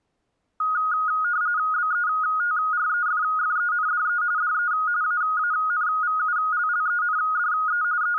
RTTY (45.45 baud, 170 Hz shift), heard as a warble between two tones, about 1350 Hz centre. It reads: BETREFFENDE DE AANVULLENDE …